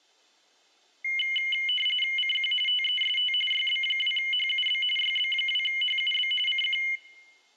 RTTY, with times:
2.2-2.5 CQ
2.7-3.3 TEST
3.5-4.8 YB2HUB
5.0-6.3 YB2HUB
6.5-6.8 CQ

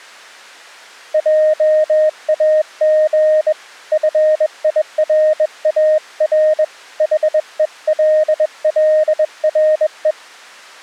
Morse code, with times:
1.1-3.5 JAG
3.9-6.6 FIRAR
7.0-10.1 HELLRE

